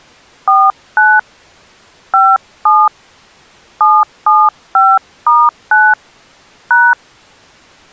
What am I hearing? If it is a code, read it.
DTMF, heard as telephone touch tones, dialled by hand, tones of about 230 ms. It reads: 49 57 775*9 #